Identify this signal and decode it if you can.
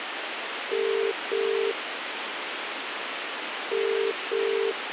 Telephone call progress tone (as in the UK, Ireland, Australia and similar networks), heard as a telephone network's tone, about 400, 450 Hz, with phone line noise. Ringback tone.